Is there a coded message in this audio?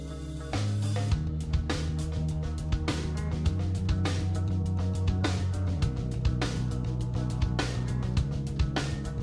No.